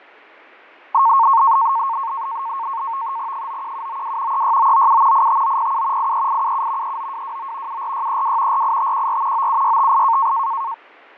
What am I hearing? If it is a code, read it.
NAVTEX (SITOR-B), 100 baud, 170 Hz shift, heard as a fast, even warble, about 1000 Hz centre, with fading. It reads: 91792 36997 85907 83877 39229 74632 48514 97658